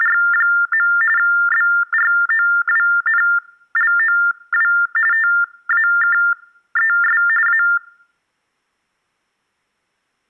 TTY/TDD text telephone tones (45.45 baud Baudot), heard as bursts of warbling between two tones, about 400 Hz shift, 1600 Hz centre. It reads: … BROWNLOW TAKES A